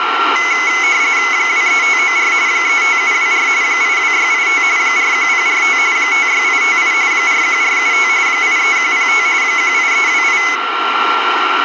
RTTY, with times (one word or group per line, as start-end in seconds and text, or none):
1.3-2.3 23594
2.5-3.5 35724
3.6-4.6 82685
4.8-5.8 41045
6.0-6.9 56858
7.1-8.1 41475
8.3-9.3 83105
9.4-10.4 18328